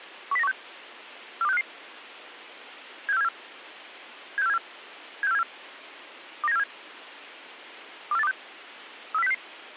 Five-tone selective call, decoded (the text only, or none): 10916 42655 76474 76474 76474 29747 24826 34066